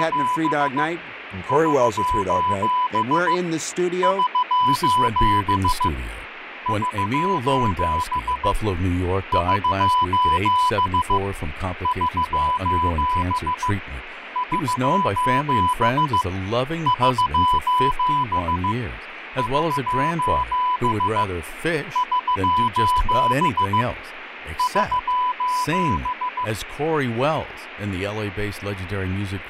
Morse code, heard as a keyed tone, hand-sent with a paddle, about 15 wpm, 1000 Hz, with radio static and fading. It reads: … <SOS> <SOS> <SOS> <SOS> <SOS> <SOS> <SOS> <SOS> <SOS> <SOS>